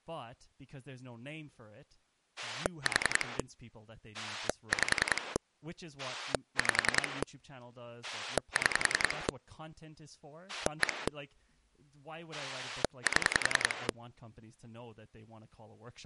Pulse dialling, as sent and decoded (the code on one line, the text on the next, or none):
4 / 5 / 5 / 6 / 1 / 7
4 5 5 6 1 7